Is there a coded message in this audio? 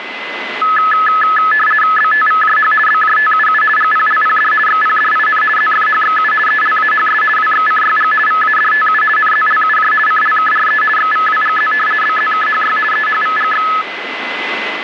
Yes: RTTY (50 baud, 450 Hz shift) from 0.6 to 13.8 s, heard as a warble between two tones, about 1500 Hz centre, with radio static and a steady whistle near 2030 Hz. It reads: BTVJH BJTUU GPLPD XPDIN ZFHXU ELAHS WXCYG VADTU NZLUJ CLKRE XVWGZ BZKHY EHVGX